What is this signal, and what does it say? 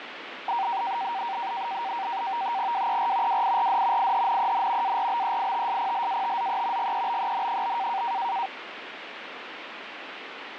NAVTEX (SITOR-B), 100 baud, 170 Hz shift, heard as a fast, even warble, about 860 Hz centre, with radio static. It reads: WER WIRD IHNEN ARBEITSPLATZE GEBEN?